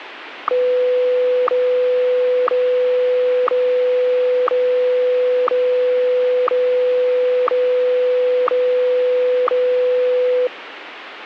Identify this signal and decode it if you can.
Radio time signal (WWVH, Hawaii), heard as ticks, one a second, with radio static.